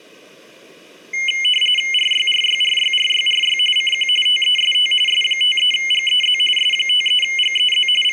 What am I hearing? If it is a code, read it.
RTTY (45.45 baud, 850 Hz shift), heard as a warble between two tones, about 2550 Hz centre. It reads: RYRYRYRYRY CQ TEST S53GEZ S53GEZ …